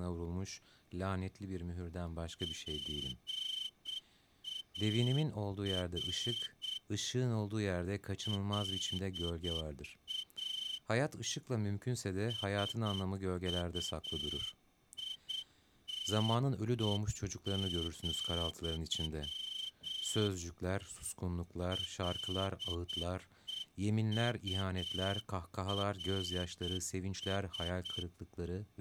Morse code, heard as a whistle, hand-sent with a straight key, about 8 wpm, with speech in Turkish. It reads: PAR LA SUITE, LEURS